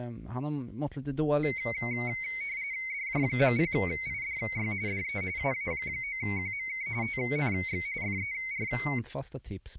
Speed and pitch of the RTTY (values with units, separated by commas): 45.45 baud, 170 Hz shift, 2150 Hz centre